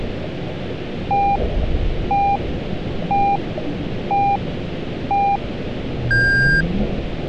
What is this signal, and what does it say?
Radio time signal (five pips and a higher one, as on Chinese radio), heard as pips.